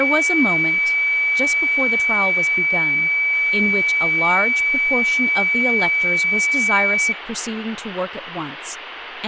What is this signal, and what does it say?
A steady tone, with room echo and speech in English. There is no code.